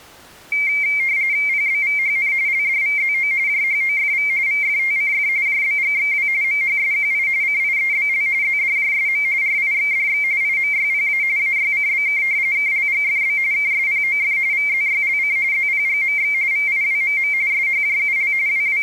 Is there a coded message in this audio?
Yes: RTTY (45.45 baud, 170 Hz shift) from 0.5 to 18.8 s, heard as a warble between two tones, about 2200 Hz centre. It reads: PBVHN LDVZO JHOFV VFTCF JBGXW MHSQI CIEBL ZDJSM RIXDX IMYPA AYCBK KLGFB KSPOF VZYLC ZPGMX VIWMM SHJUL …